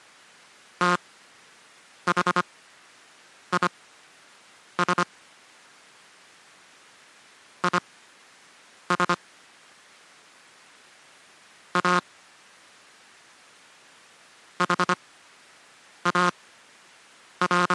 Morse code, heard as a buzzer, machine-sent, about 25 wpm, spaced as for 7 wpm. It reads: THIS IS A …